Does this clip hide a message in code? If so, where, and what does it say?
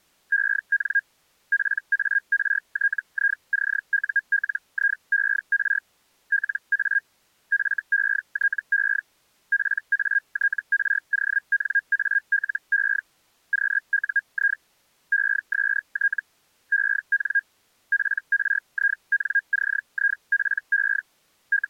Yes: Hellschreiber (Feld-Hell, 122.5 baud) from 0.3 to 21.7 s, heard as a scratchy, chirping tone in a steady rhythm, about 1600 Hz. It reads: EN PARTICULIER LA FETE PATRONALE QUI EST EN PRINCIPE …